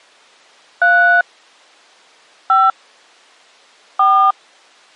DTMF, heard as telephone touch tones, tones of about 300 ms. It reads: 3 5 4